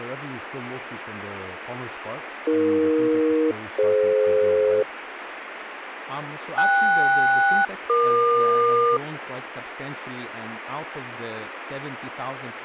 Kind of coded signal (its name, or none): aircraft SELCAL